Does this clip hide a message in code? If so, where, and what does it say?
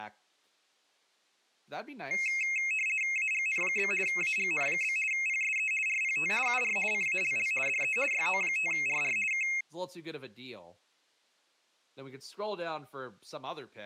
Yes: RTTY (50 baud, 450 Hz shift) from 2.1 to 9.6 s, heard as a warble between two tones, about 2350 Hz centre, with speech in English. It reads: AGN? AGN? PSE RPT UR CALL DE YO5RR K